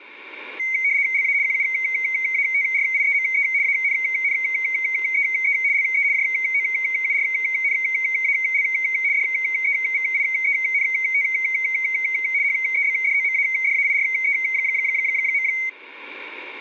RTTY (75 baud, 170 Hz shift), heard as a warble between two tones, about 2150 Hz centre, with static crashes. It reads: LA QUATRIEME ANNEE LE JOURNAL DEVIENT HEBDOMADAIRE.